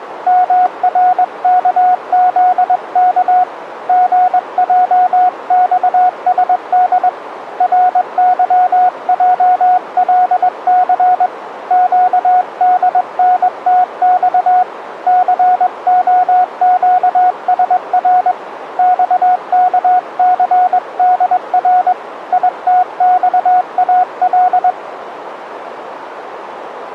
Morse code, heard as a keyed tone, hand-sent with a straight key, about 21 wpm, 730 Hz, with radio static. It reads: MRKZK GJXSD RYJLC QDNTX COQSR XKCDR ITXAL